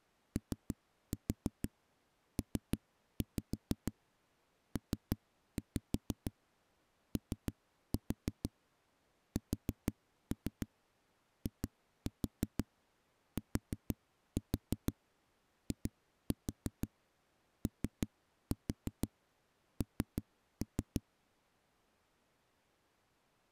Tap code, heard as knocks on a wall, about 6 knocks a second. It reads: OPPOSITION